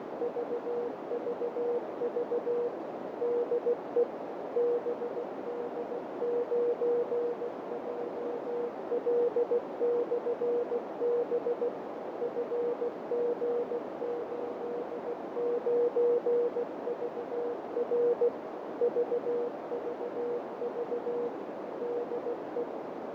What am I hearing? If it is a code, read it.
Morse code, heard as a keyed tone, machine-sent, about 16 wpm, 480 Hz, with heavy radio static, fading and a narrow filter. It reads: VVV DE BD9JL/B FG89VR VVV DE